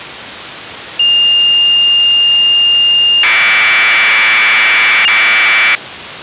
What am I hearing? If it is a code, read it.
Commodore tape loading (standard loader), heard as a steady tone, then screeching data.